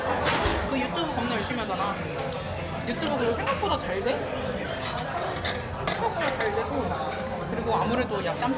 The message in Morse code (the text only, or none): none